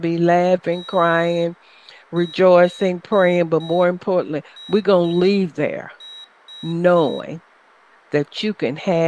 Morse code, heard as a high beeper, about 5 wpm, 3850 Hz, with room echo and speech in English. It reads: THIS